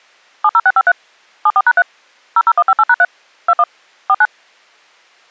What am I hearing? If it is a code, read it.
DTMF, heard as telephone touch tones, dialled by machine, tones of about 50 ms. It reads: 70653 74#3 00158#3 21 49